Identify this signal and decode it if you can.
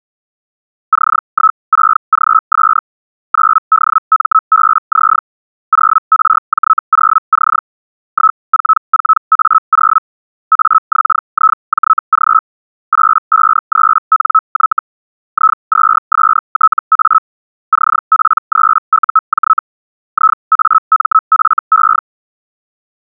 Hellschreiber (Feld-Hell, 122.5 baud), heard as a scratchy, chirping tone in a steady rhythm, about 1300 Hz. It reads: C16GS 9DMBZ 0RJ0C 144A0 AXIJG 853NY I2STA CP3UJ IAMFE